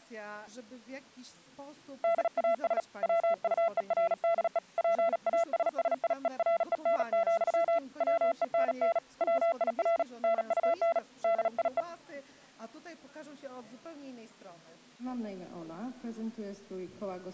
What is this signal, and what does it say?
Morse code, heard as a keyed tone, hand-sent with a paddle, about 37 wpm, 670 Hz. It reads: DAS WUERDE PASSIEREN, WENN WIR NUN DIE